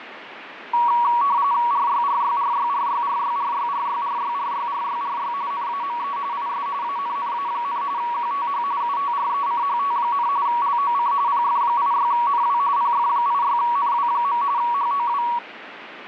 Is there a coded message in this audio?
Yes: RTTY (45.45 baud, 170 Hz shift) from 0.7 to 15.4 s, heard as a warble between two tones, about 1040 Hz centre, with radio static and fading. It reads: RYRYRYRYRYRYRYRYRYRYRY NAME IS ANNA, QTH UTRECHT, LOC PF86NW PF86NW. HOW